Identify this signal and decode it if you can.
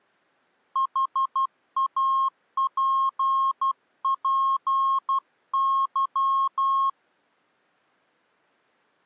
Morse code, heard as a keyed tone, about 12 wpm, 1080 Hz. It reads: HAPPY